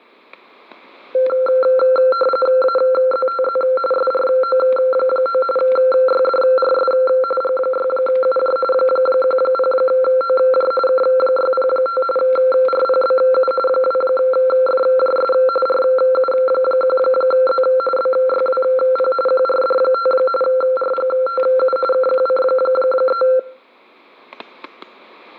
RTTY (45.45 baud, 850 Hz shift), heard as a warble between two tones, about 940 Hz centre, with static crashes. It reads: AZTZ SRO9 YDRS G6UJ 10OJ K605 RPBU 2FJS RU1Z BYWP QRD5 RGTU KQC3